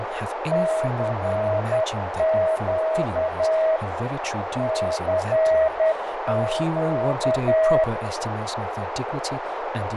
Morse code, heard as a keyed tone, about 10 wpm, 640 Hz, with heavy radio static, fading, a narrow filter and speech in English. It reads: CQ CQ